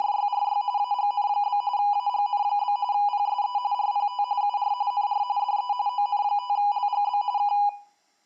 RTTY (45.45 baud, 170 Hz shift), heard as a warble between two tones, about 900 Hz centre, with room echo. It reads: … AGN? AGN? PSE RPT UR NR DE ON5LGB K